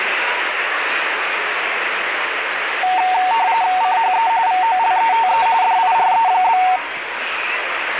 RTTY (45.45 baud, 170 Hz shift), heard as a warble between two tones, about 830 Hz centre, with radio static and the noise of a crowd indoors. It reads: CHE VOLETE DIRE?